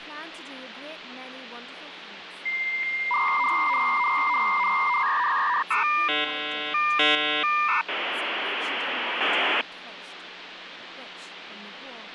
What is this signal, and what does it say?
Dial-up modem handshake (V.34 or later), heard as a whistle, warbles, then hiss, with phone line noise and speech in English.